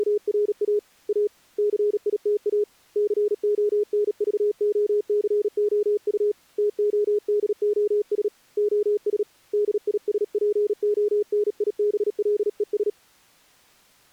Morse code, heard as a keyed tone, hand-sent with a paddle, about 37 wpm, 420 Hz. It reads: … A CITA CONVOCOU TODOS OS DISPONIBLES